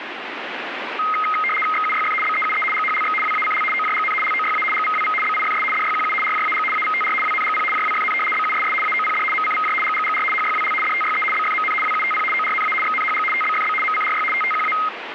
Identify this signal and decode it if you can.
RTTY (75 baud, 850 Hz shift), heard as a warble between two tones, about 1700 Hz centre, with radio static. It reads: XUYF BEUE GHLX WACL OJGN LOYA GVWV BIFS DYQU RJAG AVTR WNGP JWFN BUSS AOPD MCVJ GGGR HYWL DTYE BFMN WUTP ORNA XNHG TBFB MCRY TTQA